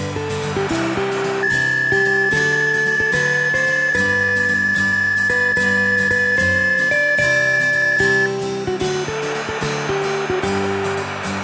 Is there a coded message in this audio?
Yes: PSK63 (62.5 baud) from 1.4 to 8.3 s, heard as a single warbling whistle, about 1750 Hz.